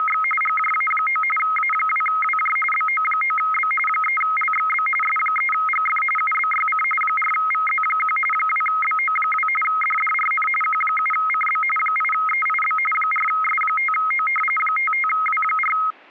RTTY (45.45 baud, 850 Hz shift), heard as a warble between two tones, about 1700 Hz centre. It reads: … GJA9 A2WJ BO9B 3LXB S3GF UBYC 4VZ1 2BO2 DDRN Q7CB 8EIB 4S5O 55W4